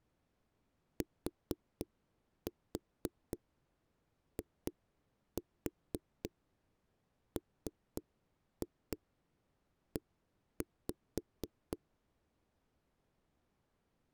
Tap code, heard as knocks on a wall, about 4 knocks a second. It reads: TIME